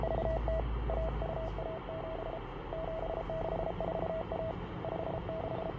Morse code (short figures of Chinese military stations), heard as a keyed tone, hand-sent with a paddle, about 33 wpm, 650 Hz, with radio static, fading, room echo and the noise inside a bus. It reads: … 1217 7641 …